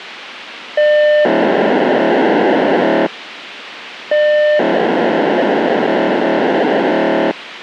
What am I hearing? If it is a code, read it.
POCSAG pager data (1200 baud), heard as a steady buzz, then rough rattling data, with radio hiss.